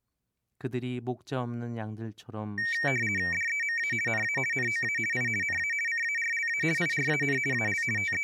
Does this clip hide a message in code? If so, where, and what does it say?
Yes: RTTY (50 baud, 450 Hz shift) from 2.6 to 8.2 s, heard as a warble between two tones, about 2050 Hz centre, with speech in Korean. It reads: DEMA NA NOA I NA CARLA IRAN AL …